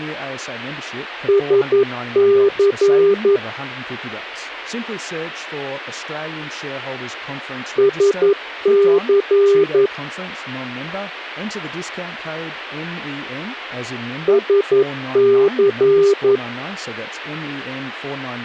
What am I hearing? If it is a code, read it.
Morse code, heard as a keyed tone, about 11 wpm, 400 Hz, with speech in English. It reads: SC SC SC